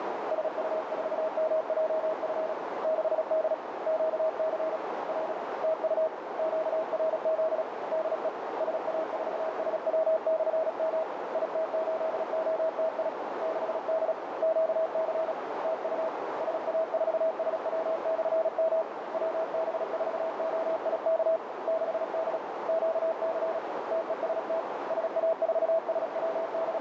Morse code, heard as a keyed tone, hand-sent with a paddle, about 36 wpm, 640 Hz, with heavy radio static and a narrow filter. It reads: SU4MJF 6D QC R TU QRZ DE SA4SW/M IT8OTI 6D QC TU SA4SW/M WB4OIK 6D QC TEST …